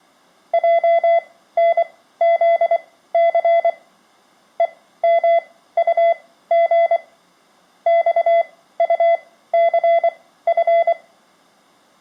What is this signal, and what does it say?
Morse code, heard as a keyed tone, machine-sent, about 24 wpm, spaced as for 15 wpm, 680 Hz, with room echo. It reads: JNZC EMUG XUCF